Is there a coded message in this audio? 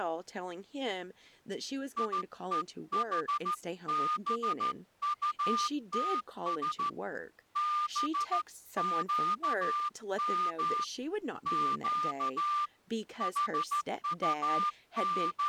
Yes: Morse code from 1.9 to 15.5 s, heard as a whistle, hand-sent with a straight key, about 13 wpm, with speech in English. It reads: IEHBUTS BQM Q …